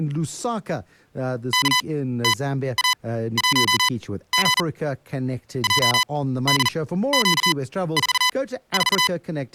Morse code, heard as electronic beeps, machine-sent, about 40 wpm, spaced as for 16 wpm, 1000 Hz, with speech in English. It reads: KTA1G JDQ44